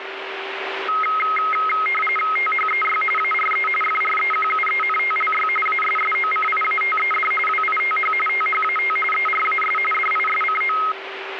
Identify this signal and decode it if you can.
RTTY (45.45 baud, 850 Hz shift), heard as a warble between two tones, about 1700 Hz centre, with radio static and a steady whistle near 390 Hz. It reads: THEY ARE FREQUENTLY ASSOCIATED WITH THAT ERAS DISCO